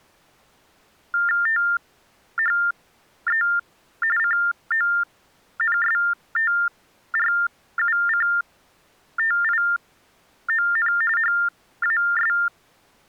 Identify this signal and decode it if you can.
TTY/TDD text telephone tones (45.45 baud Baudot), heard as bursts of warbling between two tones, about 400 Hz shift, 1600 Hz centre. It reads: THE CONSTRUCTION HAS